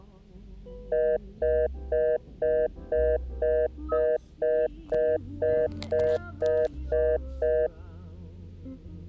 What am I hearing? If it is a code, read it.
Telephone call progress tone (North American plan), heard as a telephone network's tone, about 480, 620 Hz, 0.25 s on and 0.25 s off, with the noise inside a car. Congestion tone.